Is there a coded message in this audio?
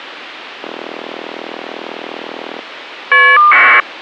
Yes: caller ID data burst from 0.6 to 3.8 s, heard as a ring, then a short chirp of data, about 1200 baud.